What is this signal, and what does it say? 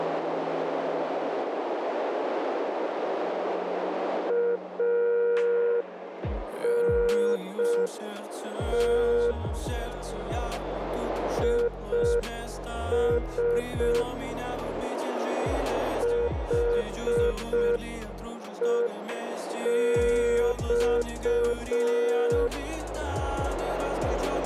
Morse code, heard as a keyed tone, hand-sent with a straight key, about 5 wpm, 480 Hz, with radio static and a narrow filter. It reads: ANT IS HEX